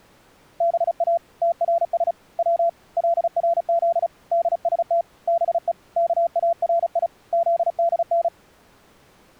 Morse code (Persian alphabet), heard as a keyed tone, hand-sent with a paddle, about 35 wpm, 680 Hz. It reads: با ترس و لرز دست به کاری زدن